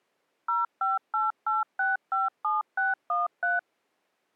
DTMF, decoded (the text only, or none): 0588657613